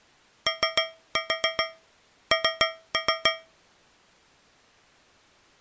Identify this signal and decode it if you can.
Tap code, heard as taps on a metal pipe, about 7 knocks a second. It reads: ON